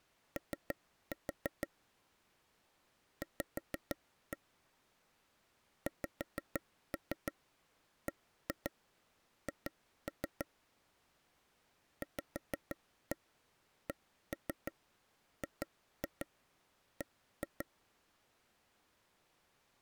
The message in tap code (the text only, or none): O V XBH VCGB